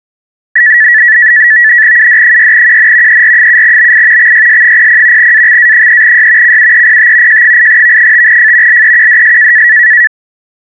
NAVTEX (SITOR-B), 100 baud, 170 Hz shift, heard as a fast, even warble, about 1850 Hz centre. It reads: UD6QN ER7BI XYS00 AXA3Y CUEPT J8V5F LEQDS